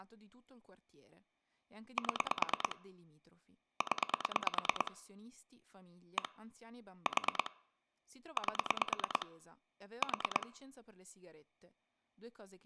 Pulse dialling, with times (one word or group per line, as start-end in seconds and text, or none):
2.0-2.8 7
3.8-4.9 0
6.2-6.3 1
7.1-7.5 4
8.4-9.3 8
10.0-10.5 4